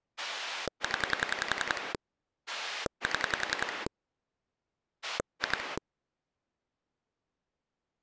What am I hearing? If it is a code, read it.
Pulse dialling, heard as a rotary dial, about 10 pulses a second. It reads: 0 7 2